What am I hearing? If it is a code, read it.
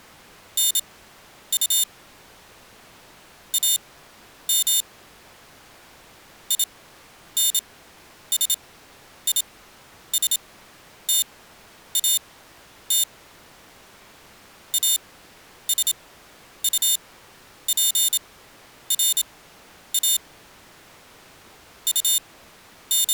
Morse code, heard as a high beeper, machine-sent, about 27 wpm, spaced as for 10 wpm, 3600 Hz. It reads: NU AM INSISTAT ASUPRA …